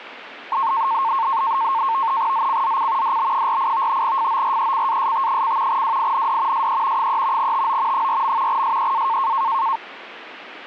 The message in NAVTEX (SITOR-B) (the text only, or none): ZCZC DB48 FORECAST: WIND SE 3 TO 4. SEA